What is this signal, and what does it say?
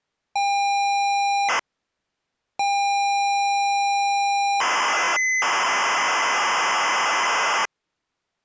ZX Spectrum tape loading, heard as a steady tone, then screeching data.